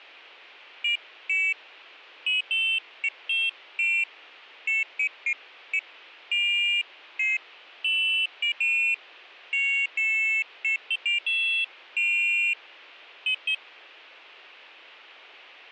Pairs of high tones at irregular times. There is no code.